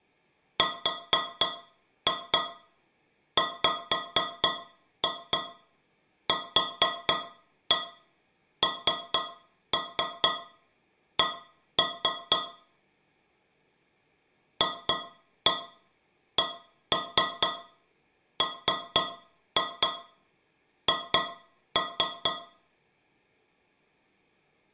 Tap code, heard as taps on a metal pipe, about 4 knocks a second, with room echo. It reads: RWQNC FCMH